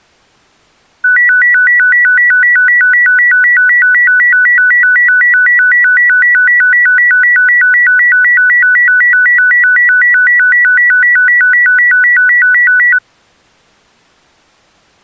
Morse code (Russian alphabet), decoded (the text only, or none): none